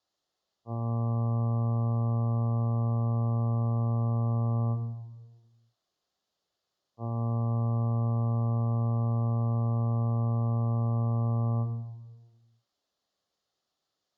Ship horn signal, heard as a ship's horn, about 120 Hz, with room echo. 2 long. At sea: a vessel under power that has stopped in fog.